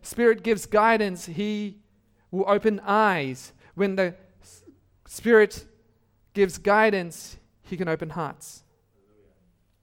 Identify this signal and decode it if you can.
Speech in English. There is no code.